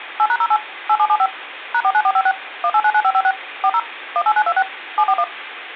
DTMF, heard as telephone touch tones, dialled by machine, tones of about 60 ms, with phone line noise. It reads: 8#08 8775 #49456 1899556 40 18926 741